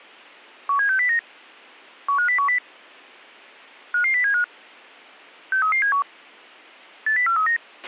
Five-tone selective call (CCIR), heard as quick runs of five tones, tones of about 100 ms, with a squelch burst at the end. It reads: 17609 15010 55075 63371 80439